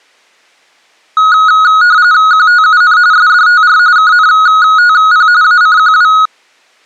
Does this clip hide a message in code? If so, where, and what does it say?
Yes: RTTY (45.45 baud, 170 Hz shift) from 1.2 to 6.3 s, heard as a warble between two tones, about 1360 Hz centre. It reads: QTUN SDTR KNTP ACQW